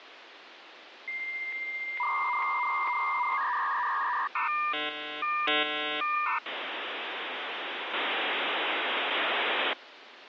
Dial-up modem handshake (V.34 or later), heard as a whistle, warbles, then hiss, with phone line noise.